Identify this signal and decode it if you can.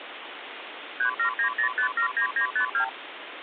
Multi-frequency trunk signalling (R2, with the far end's replies), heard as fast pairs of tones, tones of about 100 ms, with phone line noise. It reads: 3790579952